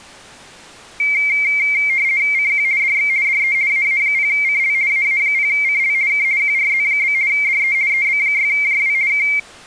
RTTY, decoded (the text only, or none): CQ DX DE AA0CL AA0CL K QRZ? DE EB6JW K